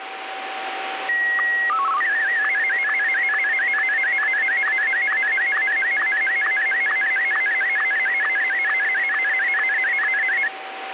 SSTV (slow-scan television), Martin M1, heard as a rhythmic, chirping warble, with radio static and a steady whistle near 770 Hz.